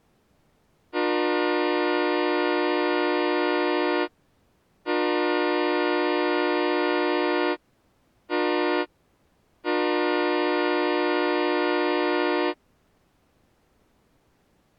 Train horn signal, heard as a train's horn. 2 long, 1 short, 1 long. On North American railways: approaching a public crossing.